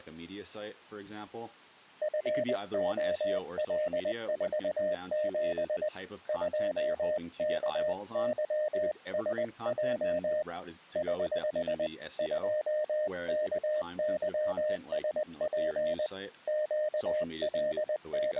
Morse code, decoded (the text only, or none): FOL47 2KYSJ <HH> 2KYSP …